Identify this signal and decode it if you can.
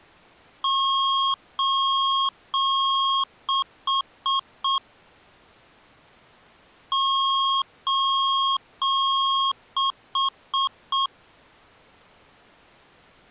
Beep code, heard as beeps from a small speaker, played twice, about 1080 Hz. 3 long, 4 short.